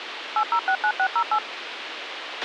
DTMF, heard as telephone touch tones, dialled by machine, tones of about 70 ms, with radio hiss and a squelch burst at the end. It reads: 8069608